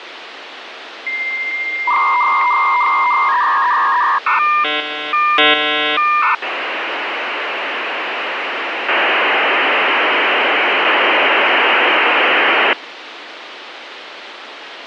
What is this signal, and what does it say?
Dial-up modem handshake (V.34 or later), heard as a whistle, warbles, then hiss, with phone line noise.